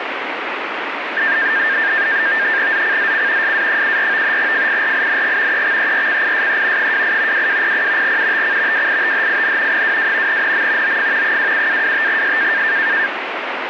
NAVTEX (SITOR-B), 100 baud, 170 Hz shift, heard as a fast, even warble, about 1700 Hz centre, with radio static. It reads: ZCZC SA74 FIRING EXERCISE 28 2200 UTC WITHIN 22 NM OF 27-25S